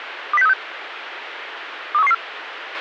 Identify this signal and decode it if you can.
Five-tone selective call (EEA), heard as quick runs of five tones, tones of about 40 ms, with radio hiss and a squelch burst at the end. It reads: 20636 23114